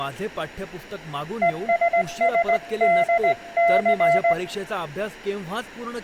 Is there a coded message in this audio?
Yes: Morse code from 1.4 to 4.4 s, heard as a keyed tone, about 18 wpm, 680 Hz, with room echo and speech in Marathi. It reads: ESSDC